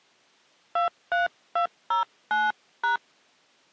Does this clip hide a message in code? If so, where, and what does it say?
Yes: DTMF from 0.8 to 3.0 s, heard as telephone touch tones, dialled by hand, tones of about 150 ms. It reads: 23209#